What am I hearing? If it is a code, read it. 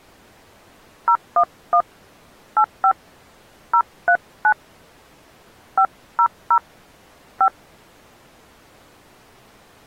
DTMF, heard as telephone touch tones, dialled by hand, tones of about 80 ms. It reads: 011 85 039 500 5